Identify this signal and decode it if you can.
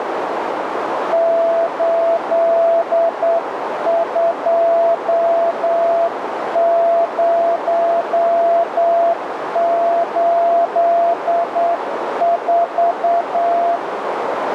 Morse code, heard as a keyed tone, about 8 wpm, 680 Hz, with heavy radio static and a narrow filter. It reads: 82084